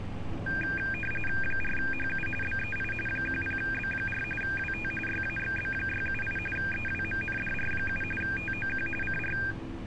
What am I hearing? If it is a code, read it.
RTTY (45.45 baud, 850 Hz shift), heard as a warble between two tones, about 2000 Hz centre, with street noise. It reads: 4HU BEI 10B4 WT YAXB678 EWMNDR7 TOQ CR